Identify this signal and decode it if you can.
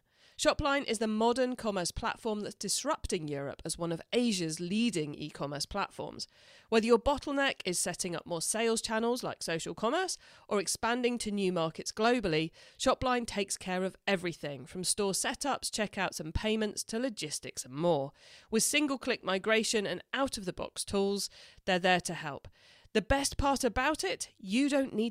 Speech in English. There is no code.